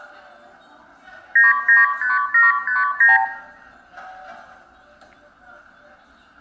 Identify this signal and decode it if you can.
Multi-frequency trunk signalling (R2, with the far end's replies), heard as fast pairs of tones, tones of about 160 ms, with room echo and the noise of a cafe. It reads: 995759